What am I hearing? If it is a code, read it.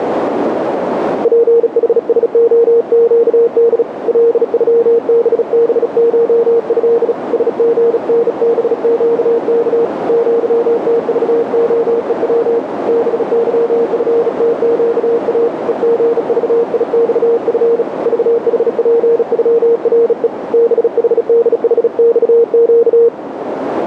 Morse code (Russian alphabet), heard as a keyed tone, hand-sent with a bug key, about 36 wpm, 470 Hz, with radio static and a narrow filter. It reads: ПХСОЩД ЛЮББШЭ СГНБЩК ЪТЖОЕВ БЫФТЩА ЕГЖИЬФ ЖХПЮРЕ БХДХЬЩ